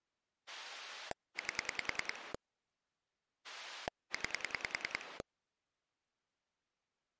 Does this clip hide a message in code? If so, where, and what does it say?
Yes: pulse dialling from 0.5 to 5.2 s, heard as a rotary dial, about 10 pulses a second. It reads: 8 9